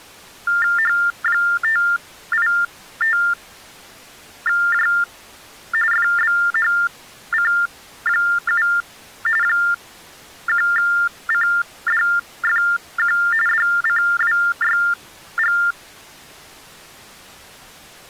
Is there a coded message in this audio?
Yes: TTY/TDD text telephone tones (45.45 baud Baudot) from 0.5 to 15.7 s, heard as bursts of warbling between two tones, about 400 Hz shift, 1600 Hz centre. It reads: H585J FBHC7 1CDFQ DCWYG